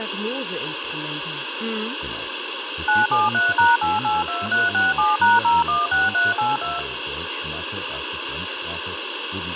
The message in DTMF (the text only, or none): 973#882367#016382